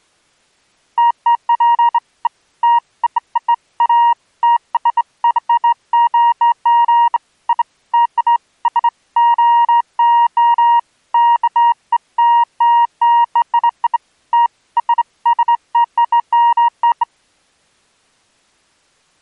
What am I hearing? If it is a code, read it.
Beeps of irregular length. There is no code.